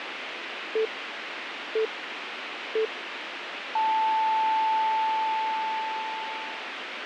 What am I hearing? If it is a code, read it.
Radio time signal (three low pips and a long one an octave up, as on NHK), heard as pips, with radio hiss.